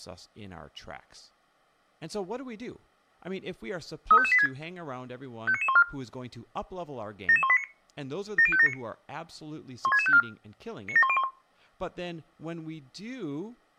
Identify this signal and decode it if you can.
Five-tone selective call (ZVEI), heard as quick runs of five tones, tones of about 70 ms, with speech in English. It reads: 35586 59914 77189 70579 16654 97101